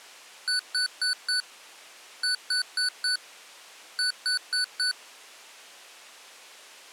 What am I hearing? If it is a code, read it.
Beep code, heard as beeps from a small speaker, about 1490 Hz. 4-4-4.